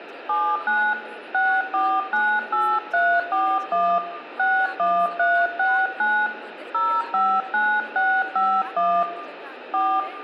DTMF, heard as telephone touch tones, dialled by hand, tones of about 260 ms, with room echo and speech in Maithili. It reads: 79 6498341 61369 059651 4